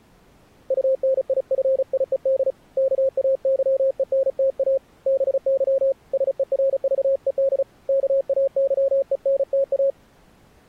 Morse code, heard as a keyed tone, hand-sent with a paddle, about 35 wpm, 540 Hz. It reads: UNIFIED KAYENTA BY SERVED KAYENTA